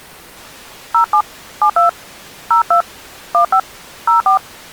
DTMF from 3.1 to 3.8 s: 15

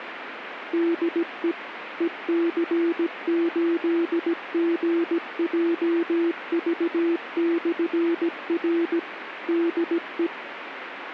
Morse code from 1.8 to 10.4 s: EC8GJV/R DE

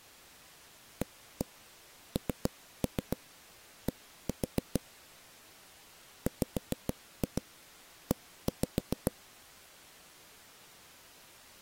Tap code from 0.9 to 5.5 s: AND

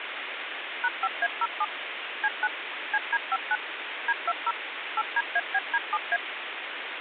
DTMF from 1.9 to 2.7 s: C9

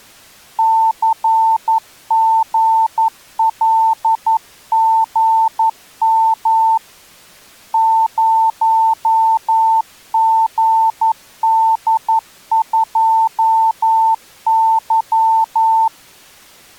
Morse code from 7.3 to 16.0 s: 0GD2Y

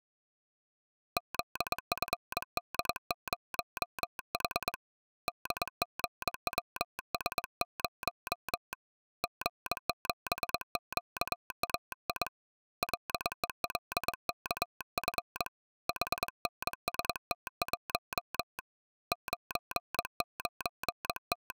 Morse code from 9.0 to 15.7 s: G7QAI LELKF

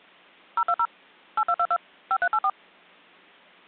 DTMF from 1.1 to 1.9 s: 8222

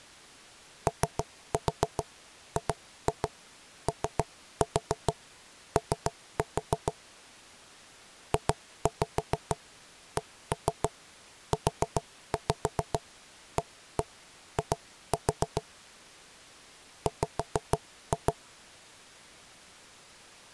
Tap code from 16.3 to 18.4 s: W

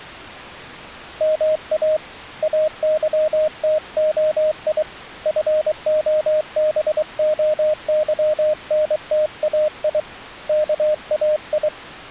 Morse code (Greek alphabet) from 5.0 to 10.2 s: ΦΟΒΟΥΝΤΑΙ

